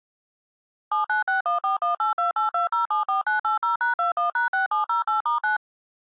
DTMF, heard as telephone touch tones, dialled by machine, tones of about 130 ms. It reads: 7961418282074980#21#6708*9